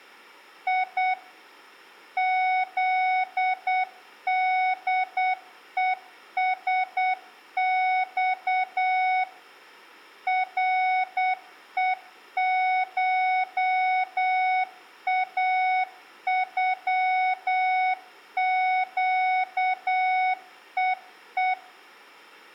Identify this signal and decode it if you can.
Morse code (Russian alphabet), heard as a keyed tone, machine-sent, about 8 wpm, 740 Hz, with room echo. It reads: И ЗДЕСЬ РЕШАЮЩЕЕ